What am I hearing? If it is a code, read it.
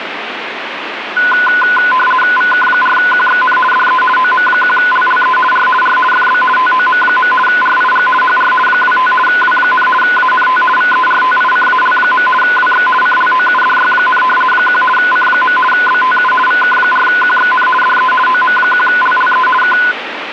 RTTY (50 baud, 450 Hz shift), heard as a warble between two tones, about 1250 Hz centre, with radio static. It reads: VK4QXN DE OM1LLE R R FB TOM. RIG HR 25 W, ANT VERTICAL. WX CLOUDY, 1 C. BTU VK4QXN DE OM1LLE K